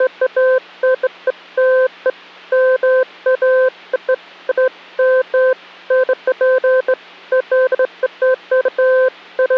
Beeps of irregular length. There is no code.